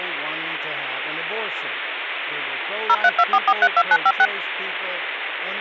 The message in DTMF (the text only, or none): 0324432956